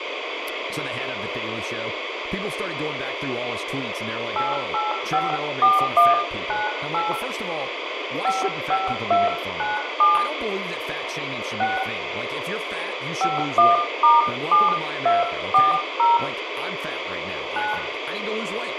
DTMF, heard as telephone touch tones, dialled by hand, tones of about 170 ms, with radio hiss, room echo and speech in English. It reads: 8854198 55297 6 51*7240 9